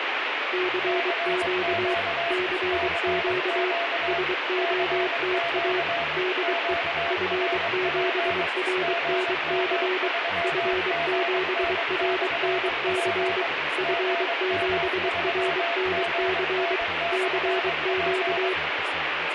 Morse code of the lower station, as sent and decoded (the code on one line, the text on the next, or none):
-.-. --.- / -.-. --.- / ... --- - .- / -.. . / ..-. --... .-. -. -.-. / ..-. --... .-. -. -.-. / ..-. --... .-. -. -.-. / -.-. --.-
CQ CQ SOTA DE F7RNC F7RNC F7RNC CQ